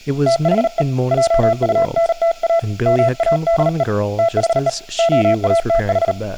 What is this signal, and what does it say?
Morse code, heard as a keyed tone, hand-sent with a paddle, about 38 wpm, 670 Hz, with speech in English. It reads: THE JUNTA MADE THE OATH